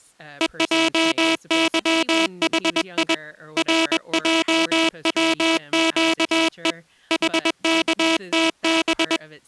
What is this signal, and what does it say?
Morse code, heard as a buzzer, hand-sent with a paddle, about 21 wpm, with speech in English. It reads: EJYHI RJWQE HKTB